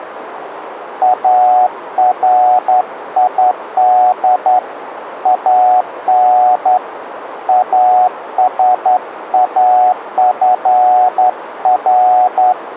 Morse code (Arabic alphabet), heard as a keyed tone, hand-sent with a straight key, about 11 wpm, 740 Hz, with radio static. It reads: اريد ان اسافر